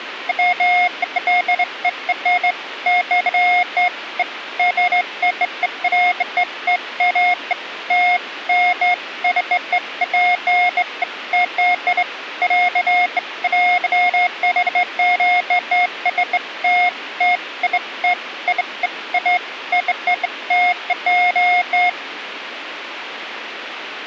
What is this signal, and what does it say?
Beeps of irregular length, with radio hiss. There is no code.